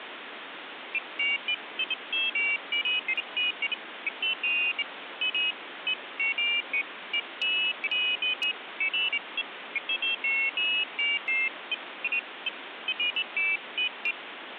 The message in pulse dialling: none

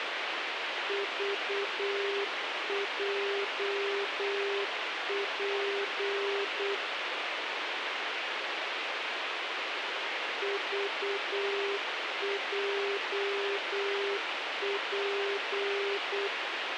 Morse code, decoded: VJP VJP

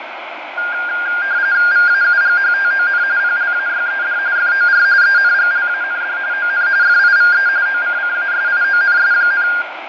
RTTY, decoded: VAUGHTON PLAYED FOR ENGLAND ON FIVE OCCASIONS,

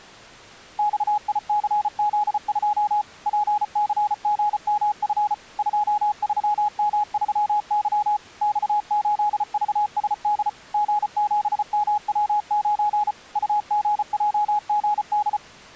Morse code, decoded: XICZ2 PCGMF 23M3Y X8VSD G7MW9 UGJGD

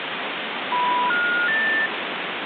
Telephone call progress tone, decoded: special information tone

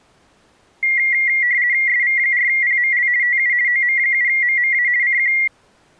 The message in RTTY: SV4PML TU OM7MMA CQ

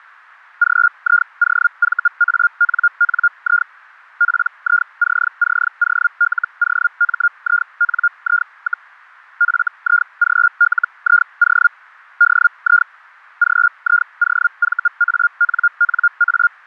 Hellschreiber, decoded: GIOVANNI PICCOLOMINI, FIGLIO DI GIOVANNA

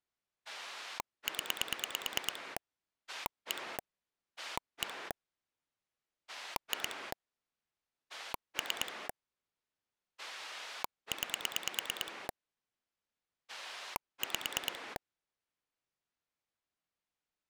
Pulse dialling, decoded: 0 1 1 2 3 9 5

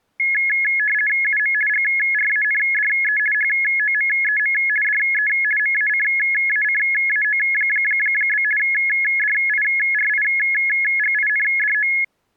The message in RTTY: UM GRANDE HOMEM DE MACACAO? DIRIGINDO

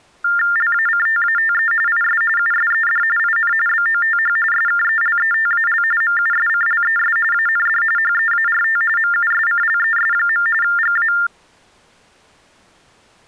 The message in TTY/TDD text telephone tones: LACTATE IS USED IN BOTH SKELETAL MUSCLES AND HEART MUSCLES. GA

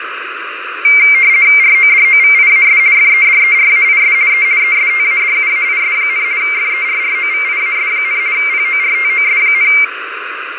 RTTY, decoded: RODOVIAS FEDERAIS E ESTADUAIS, FERROVIAS, PORTOS,

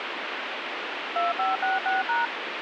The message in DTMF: 2566#

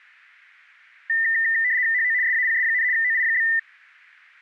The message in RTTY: HO SAPS, OI?

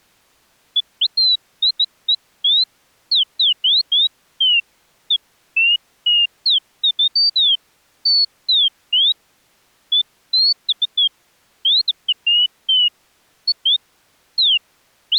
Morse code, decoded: none

